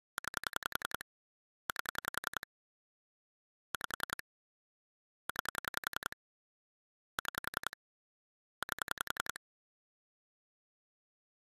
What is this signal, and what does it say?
Pulse dialling, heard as clicks on a phone line, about 10 pulses a second. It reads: 9 8 5 9 6 8